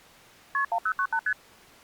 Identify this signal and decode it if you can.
Multi-frequency trunk signalling (R1, as on North American trunks), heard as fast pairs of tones, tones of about 70 ms. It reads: KP 1098 ST